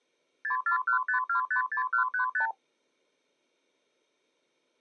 Multi-frequency trunk signalling (R2, with the far end's replies), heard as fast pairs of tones, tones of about 110 ms. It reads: 6415256135